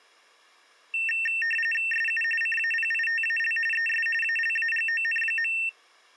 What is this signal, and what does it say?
RTTY (45.45 baud, 850 Hz shift), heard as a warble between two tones, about 2250 Hz centre. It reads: SU CAPITAL ES ALAGON.